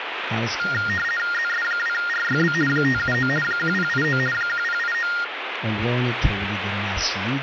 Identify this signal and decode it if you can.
RTTY (50 baud, 450 Hz shift), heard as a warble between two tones, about 1650 Hz centre, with radio static. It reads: ZS2RYB 579 1089 1089